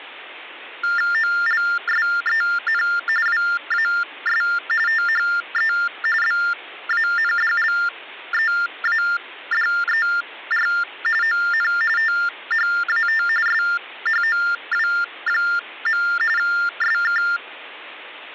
TTY/TDD text telephone tones (45.45 baud Baudot), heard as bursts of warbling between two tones, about 400 Hz shift, 1600 Hz centre, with hum. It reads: OLSEN WAS THE BANDLEADER ON THAT SHOW. SK